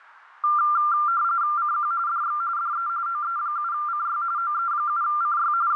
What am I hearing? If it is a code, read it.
RTTY (45.45 baud, 170 Hz shift), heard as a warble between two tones, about 1280 Hz centre, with radio static. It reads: CQ DX DE OE7CY OE7CY …